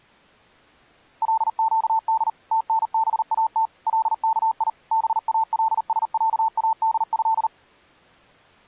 Morse code (Arabic alphabet), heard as a keyed tone, machine-sent, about 39 wpm, 890 Hz. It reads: لقد تنبات لكي بالسعاده